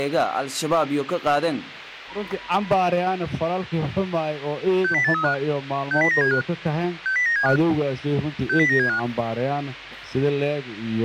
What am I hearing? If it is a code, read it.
Five-tone selective call (CCIR), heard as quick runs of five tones, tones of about 100 ms, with radio hiss. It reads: 60835 60975 60975 60975